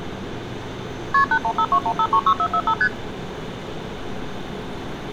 Multi-frequency trunk signalling (R1, as on North American trunks), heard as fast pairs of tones, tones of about 70 ms, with street noise. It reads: KP 81521536445 ST